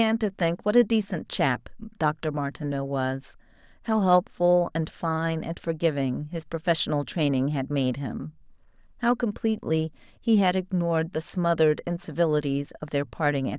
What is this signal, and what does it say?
Speech in English. There is no code.